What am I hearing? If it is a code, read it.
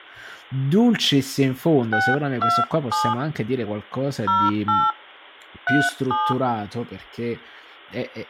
DTMF, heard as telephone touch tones, dialled by hand, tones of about 220 ms, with speech in Italian. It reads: 627 08 37